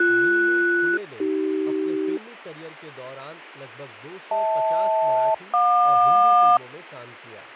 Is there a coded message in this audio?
Yes: aircraft SELCAL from 0.0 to 6.6 s, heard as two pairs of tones, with radio static, fading and speech in Hindi. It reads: BS-AC HL-JQ